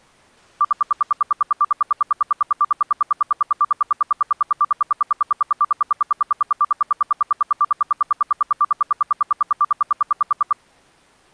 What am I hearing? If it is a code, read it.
Radio time signal (RWM, Moscow), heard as ten pulses a second.